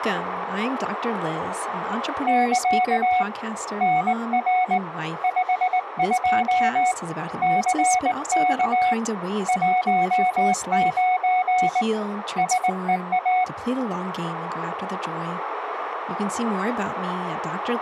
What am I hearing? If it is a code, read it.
Morse code, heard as a keyed tone, hand-sent with a straight key, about 19 wpm, 740 Hz, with radio static and speech in English. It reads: <KA> NR 52 CK 19 SEA